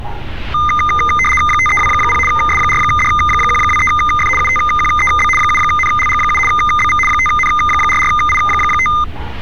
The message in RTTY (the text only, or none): 5320 S4D123F UTQEB 7NLG7 BV 5N44I5